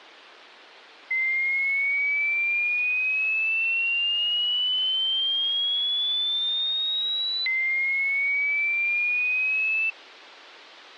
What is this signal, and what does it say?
A tone that sweeps in pitch again and again. There is no code.